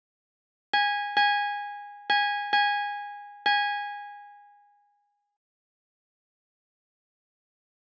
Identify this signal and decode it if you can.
Ship's bell, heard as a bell, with room echo. 5. Five half-hours of the watch have passed.